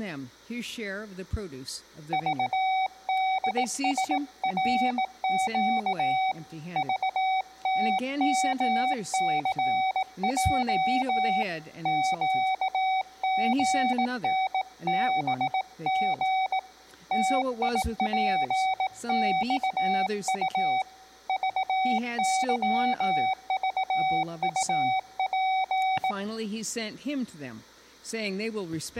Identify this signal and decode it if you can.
Morse code, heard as a keyed tone, hand-sent with a bug key, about 18 wpm, 760 Hz. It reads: VDSRQ VTMCJ QGNBG TIPXU VYVUP